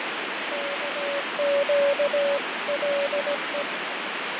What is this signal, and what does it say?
Morse code (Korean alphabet), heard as a keyed tone, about 17 wpm, 560 Hz, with heavy radio static and fading. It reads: 애가